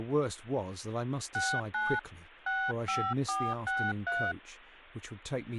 DTMF, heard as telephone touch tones, dialled by hand, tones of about 250 ms, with speech in English. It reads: 69 65463